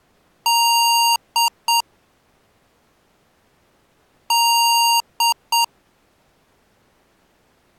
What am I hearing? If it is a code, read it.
Beep code, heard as beeps from a small speaker, played twice, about 930 Hz. 1 long, 2 short. In Award, IBM and AMI BIOS tables: video adapter failure.